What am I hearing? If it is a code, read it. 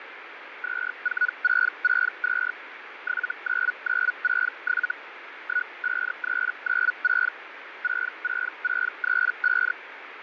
Hellschreiber (Feld-Hell, 122.5 baud), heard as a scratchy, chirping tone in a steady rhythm, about 1470 Hz, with radio static and fading. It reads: 24662 79967 15396 66635